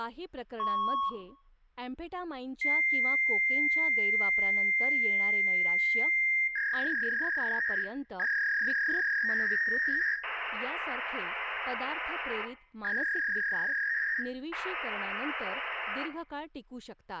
Fax machine handshake, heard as a beep, a long tone, a warble and hiss, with room echo and speech in Marathi.